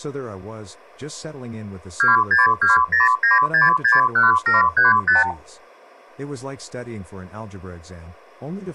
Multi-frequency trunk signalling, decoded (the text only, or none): 26209661735